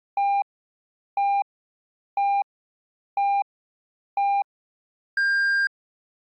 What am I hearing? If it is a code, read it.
Radio time signal (five pips and a higher one, as on Chinese radio), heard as pips.